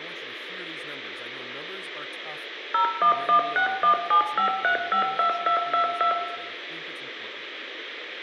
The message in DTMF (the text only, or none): 0116175352222